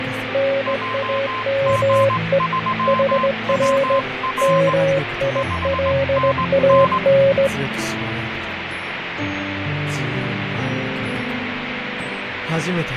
Morse code, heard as two keyed tones, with radio static and fading. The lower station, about 19 wpm, 550 Hz: NAME HR MILAN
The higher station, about 19 wpm, 1040 Hz: JG3WR 5NN